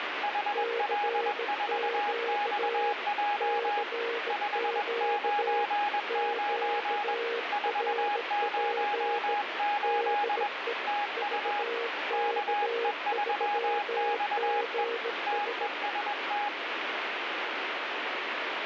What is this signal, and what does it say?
Morse code, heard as two keyed tones, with radio static. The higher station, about 21 wpm, 830 Hz: HL4XJ 599 408 TU KE3XE TEST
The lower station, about 17 wpm, 470 Hz: CQ CQ QRP DE VK3GS